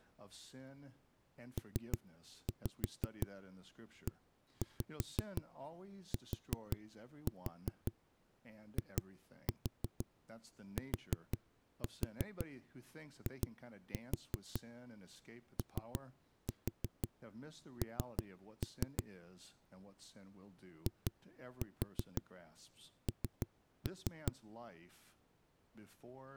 Tap code, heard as knocks on a wall, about 5 knocks a second, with speech in English. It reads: PETITION IN